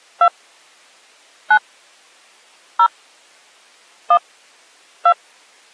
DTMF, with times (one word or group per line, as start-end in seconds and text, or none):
0.2-0.3 2
1.5-1.6 9
2.8-2.9 0
4.1-4.2 1
5.1-5.1 2